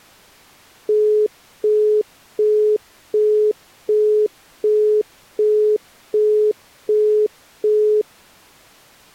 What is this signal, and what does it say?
Telephone call progress tone (as in the UK, Australia and similar networks), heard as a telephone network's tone, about 420 Hz, 0.375 s on and 0.375 s off. Busy tone.